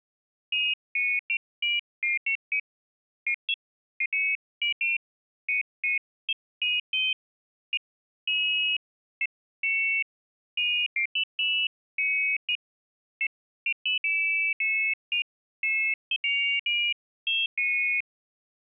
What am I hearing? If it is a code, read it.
Pairs of high tones at irregular times. There is no code.